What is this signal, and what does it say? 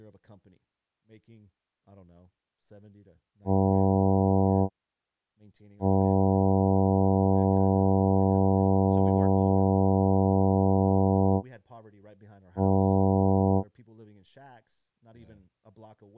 Ship horn signal, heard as a ship's horn, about 100 Hz, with speech in English. 1 short, 1 long, 1 short. At sea: a vessel at anchor warns of its position.